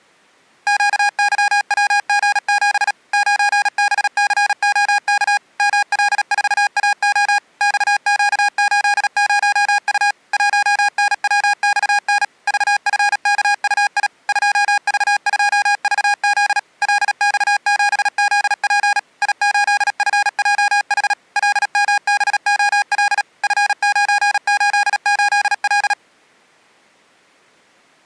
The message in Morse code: QYWG7 9BCOK ML4AO XQ80U 1NWXN VFKUI 2V2VZ LX7ZP I8FJH LMBOL F988L

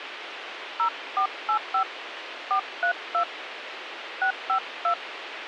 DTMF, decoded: 0485 432 652

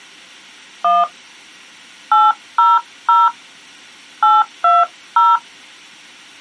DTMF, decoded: 1 800 820

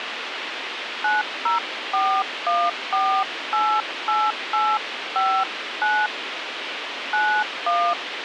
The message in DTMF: 9041488859 91

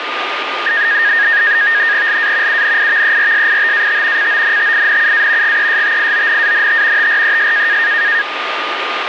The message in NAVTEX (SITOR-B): LA UNIVERSITAT CONTINUA GESTIONANT TRES

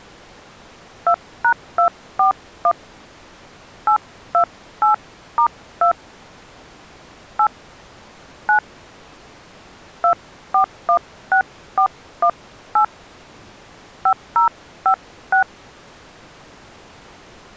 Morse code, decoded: none

